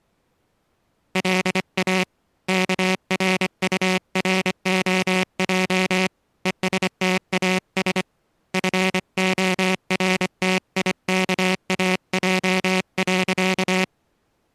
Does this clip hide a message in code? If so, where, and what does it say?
Yes: Morse code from 1.1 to 13.9 s, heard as a buzzer, hand-sent with a paddle, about 25 wpm. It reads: LA KRUROJ ESTAS FORTIKAJ.